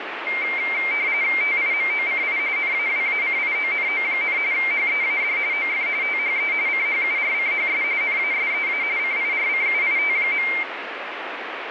RTTY (45.45 baud, 170 Hz shift), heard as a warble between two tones, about 2200 Hz centre, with radio static. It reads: TIMOCI NAWACIONO, HEAD OF THE CHURCHS NASEA CIRCUIT.